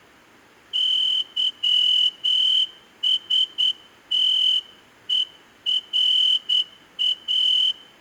Morse code (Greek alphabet), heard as a whistle, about 9 wpm. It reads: ΥΣΤΕΡΑ